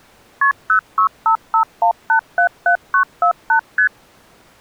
Multi-frequency trunk signalling (R1, as on North American trunks), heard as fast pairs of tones, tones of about 90 ms. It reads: KP 06551877948 ST